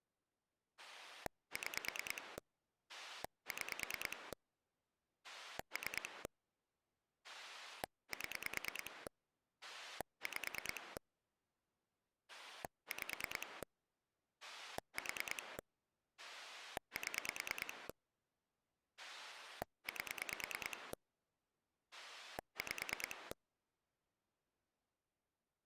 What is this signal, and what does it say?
Pulse dialling, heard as a rotary dial, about 9 pulses a second. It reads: 6 6 3 7 5 5 4 7 8 5